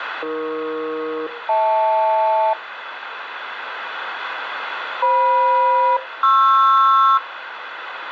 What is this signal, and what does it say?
Aircraft SELCAL, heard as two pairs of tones, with radio static and room echo. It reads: AE-HL FM-PR